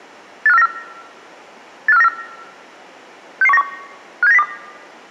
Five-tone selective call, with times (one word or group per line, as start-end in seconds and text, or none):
0.5-0.7 85494
1.9-2.1 85494
3.4-3.6 66191
4.2-4.4 57902